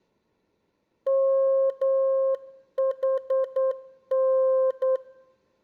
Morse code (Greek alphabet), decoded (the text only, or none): ΜΗΝ